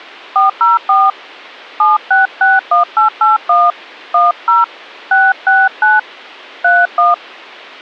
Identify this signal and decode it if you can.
DTMF, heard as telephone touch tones, dialled by hand, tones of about 160 ms. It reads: 404 7661881 10 669 31